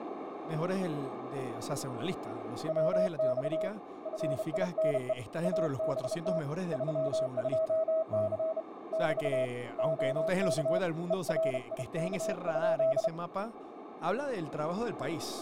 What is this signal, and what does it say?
Morse code, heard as a keyed tone, hand-sent with a bug key, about 32 wpm, 640 Hz, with radio static, a narrow filter and speech in Spanish. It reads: WX FINE ABT 32C <BT> OK ERIK?